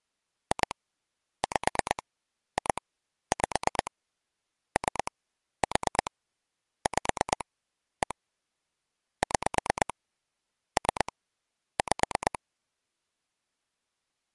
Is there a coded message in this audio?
Yes: pulse dialling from 0.5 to 12.4 s, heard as clicks on a phone line, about 8 pulses a second. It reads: 2 5 2 5 3 4 5 1 6 3 5